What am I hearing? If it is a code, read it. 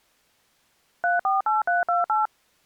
DTMF, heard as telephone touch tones, dialled by machine, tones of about 160 ms. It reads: 348328